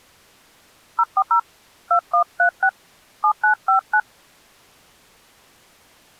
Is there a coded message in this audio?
Yes: DTMF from 1.0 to 4.0 s, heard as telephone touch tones, dialled by hand, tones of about 80 ms. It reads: 040 2136 7959